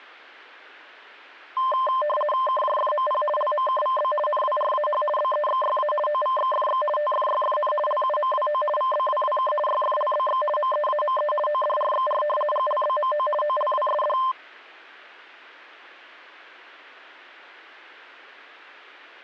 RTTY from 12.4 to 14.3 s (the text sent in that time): GLBMO OLWSD